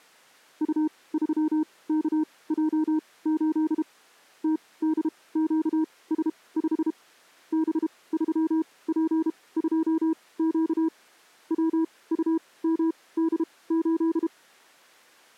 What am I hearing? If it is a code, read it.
Morse code, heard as a keyed tone, machine-sent, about 32 wpm, spaced as for 21 wpm, 320 Hz. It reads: U3KJ8 TDQS5 B3P2Q WUMD8